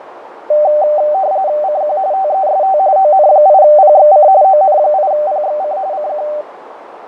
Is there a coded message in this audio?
Yes: RTTY (45.45 baud, 170 Hz shift) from 0.5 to 6.4 s, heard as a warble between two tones, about 680 Hz centre, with radio static, fading and a narrow filter. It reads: CQ TEST ON8PXC ON8PXC CQ